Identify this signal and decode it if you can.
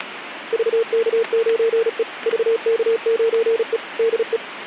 Morse code, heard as a keyed tone, machine-sent, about 36 wpm, 460 Hz, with radio static. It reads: VK9E VK9E DE